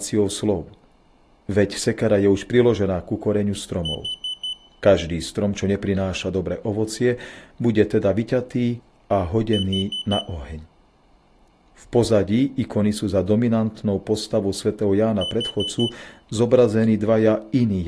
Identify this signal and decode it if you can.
Alarm pattern, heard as an alarm's beeps, played three times, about 3000 Hz, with room echo and speech in Slovak. Temporal four. Carbon monoxide.